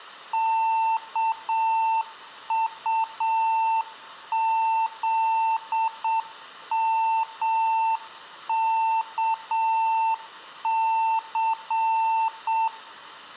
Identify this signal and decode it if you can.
Morse code, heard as a keyed tone, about 7 wpm, 900 Hz, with room echo. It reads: KUZMKC